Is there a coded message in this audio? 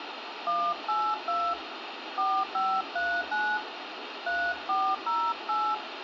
Yes: DTMF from 0.5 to 5.7 s, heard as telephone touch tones, dialled by hand, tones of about 260 ms, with radio hiss and room echo. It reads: 182 4539 3408